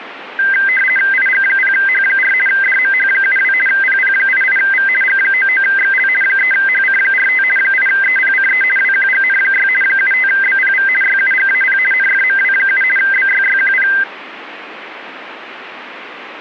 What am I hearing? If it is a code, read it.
RTTY (50 baud, 450 Hz shift), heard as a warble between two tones, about 1800 Hz centre. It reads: IG0H4 DMH72 PP88V G99XL 3HC45 8EPCE WQGN6 75BPV YUGAP NFMW7 BYYQP